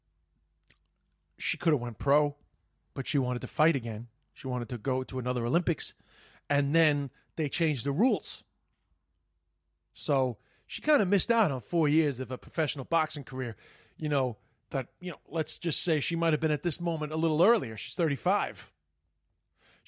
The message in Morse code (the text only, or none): none